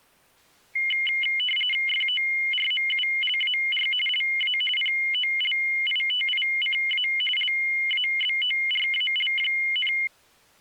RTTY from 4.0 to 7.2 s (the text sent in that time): LA POLITICA